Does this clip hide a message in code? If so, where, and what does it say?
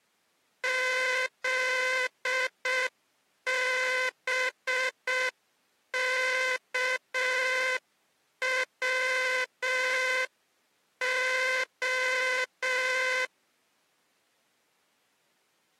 Yes: Morse code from 0.6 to 13.3 s, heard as a buzzer, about 6 wpm. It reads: ZBKWO